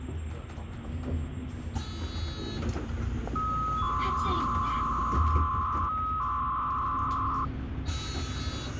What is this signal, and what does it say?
300-baud modem data (Bell 103 tones), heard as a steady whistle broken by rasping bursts, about 300 baud, 200 Hz shift, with phone line noise and the noise inside a bus.